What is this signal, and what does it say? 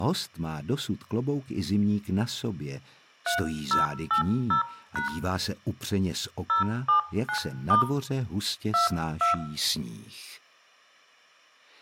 DTMF, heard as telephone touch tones, dialled by hand, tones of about 120 ms, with room echo. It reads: 3080# 079* 22